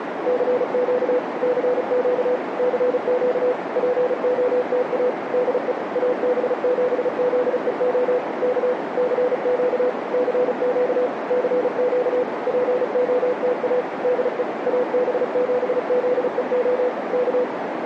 Morse code, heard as a keyed tone, machine-sent, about 35 wpm, 500 Hz, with radio static and a narrow filter. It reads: CQ CQ CQ POTA DE AB7ZEO K CQ CQ CQ POTA DE AB7ZEO K